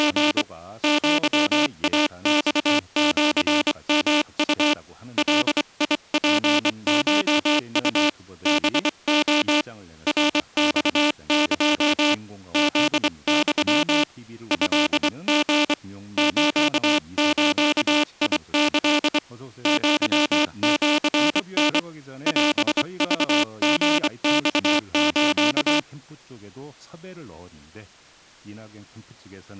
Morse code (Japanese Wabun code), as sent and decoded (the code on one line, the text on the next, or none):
… / --.-- .- -..- --.-. -- ..- / .-.. .. .--. ---- ..- / -... --- / .-. -..- -.--- / --.. -..-- / ..-.. --. / ---.- ---.- .. -.-.. / --.-- --.-. -. / .-... ...- --. -..- ---.-
… アイマシヨウ ガツコウ ハレ ナマエ フユ トリ スズキ アシタ オクリマス